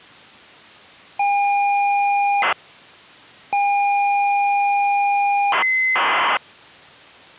ZX Spectrum tape loading, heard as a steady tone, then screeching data.